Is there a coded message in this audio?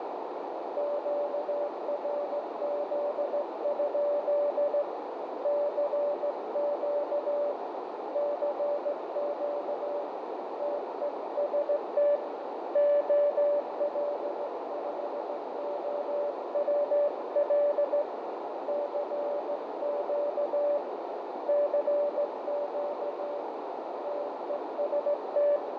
Yes: Morse code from 0.7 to 25.6 s, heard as a keyed tone, hand-sent with a straight key, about 16 wpm, 580 Hz, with heavy radio static, fading and a narrow filter. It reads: QRZ? CQ CQ TEST OL5OWL CQ CQ TEST